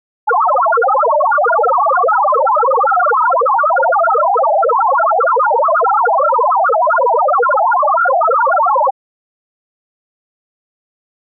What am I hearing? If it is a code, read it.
Multi-tone FSK (Olivia or MFSK type), about 1000 Hz wide, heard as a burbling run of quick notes, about 62.5 baud.